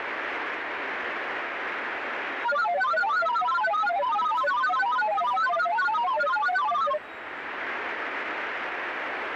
Multi-tone FSK (Olivia or MFSK type), about 1000 Hz wide, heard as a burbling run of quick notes, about 31.25 baud, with radio static and the noise of a subway station.